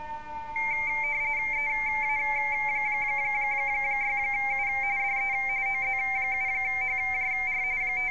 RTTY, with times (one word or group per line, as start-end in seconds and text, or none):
1.5-4.7 EA6U
5.0-5.3 DE
5.7-7.6 OZ7HJR
7.8-8.1 …